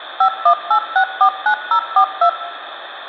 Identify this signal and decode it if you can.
DTMF, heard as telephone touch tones, dialled by machine, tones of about 80 ms, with phone line noise and room echo. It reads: 518649042